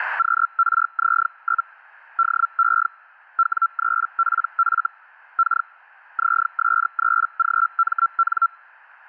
Hellschreiber (Feld-Hell, 122.5 baud), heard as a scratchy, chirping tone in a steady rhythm, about 1350 Hz. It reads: QRZ? DE W3PF K ZS3GMN